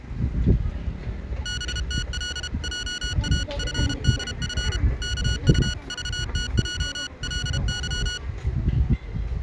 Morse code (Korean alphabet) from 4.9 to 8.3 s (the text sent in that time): 이렇게